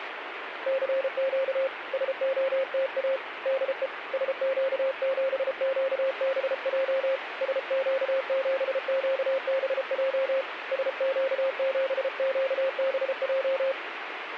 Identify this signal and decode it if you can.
Morse code, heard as a keyed tone, hand-sent with a paddle, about 33 wpm, 530 Hz, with radio static. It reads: CQ SOTA DE SQ7QBJ SQ7QBJ SQ7QBJ